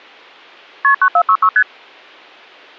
Multi-frequency trunk signalling (R1, as on North American trunks), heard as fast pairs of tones, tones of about 70 ms. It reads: KP 9466 ST